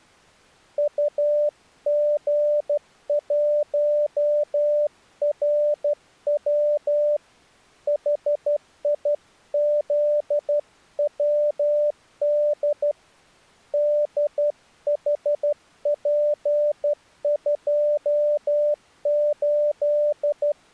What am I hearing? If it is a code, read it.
Morse code, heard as a keyed tone, hand-sent with a straight key, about 12 wpm, 590 Hz. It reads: UG1RW HIZWD DHP28